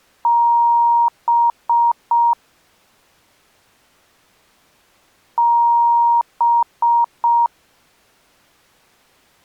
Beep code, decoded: 1 long, 3 short

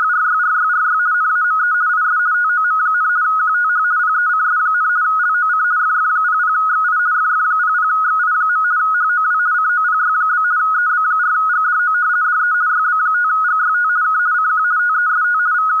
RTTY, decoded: … NAME IS TOM, QTH PECS, LOC FF00XI FF00XI. HOW COPY? EB4GDO DE YB5GYT K CQ TEST …

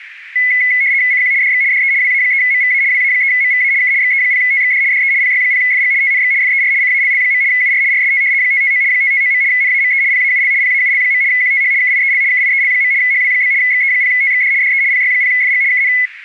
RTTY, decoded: CQ DX DE WA3MVA WA3MVA K XE0TXD DE PY0FG TNX FER CALL. UR RST 559 559. NAME PAUL PAUL. QTH KIEL KIEL. HW? XE0TXD DE PY0FG KN

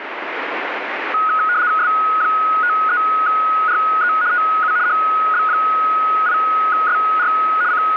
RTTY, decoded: S53RE TU HB8SR …

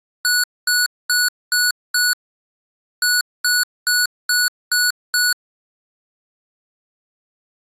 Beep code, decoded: 5-6

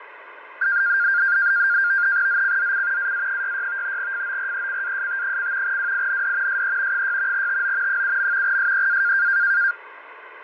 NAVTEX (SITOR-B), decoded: ZCZC AA66 FORECAST: WIND SE 6 TO 7. SEA

